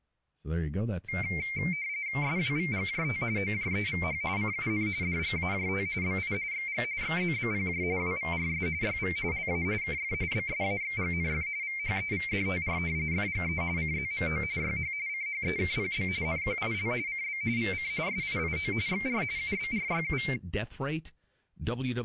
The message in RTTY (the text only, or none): SWVGJT OJEVH CUN DGAJT BI XG XZBPJ WVRS YV LA KF BSAXGNF VHEVDTR FGE CZMO YH CHEKPB NQIL CB VC SIIO XR UBRYU